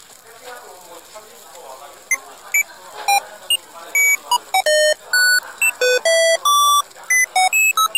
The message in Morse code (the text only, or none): none